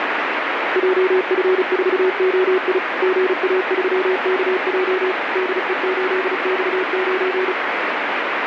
Morse code, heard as a keyed tone, machine-sent, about 35 wpm, 370 Hz, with heavy radio static. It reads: JF4OI GA3KJ DE8X9